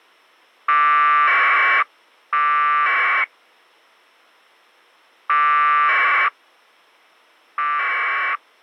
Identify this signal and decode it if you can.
Packet radio (AX.25, as in APRS), 1200 baud, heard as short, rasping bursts.